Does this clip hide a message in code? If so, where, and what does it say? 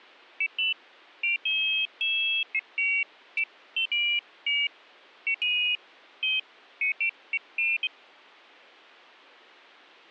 No, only pairs of high tones at irregular times.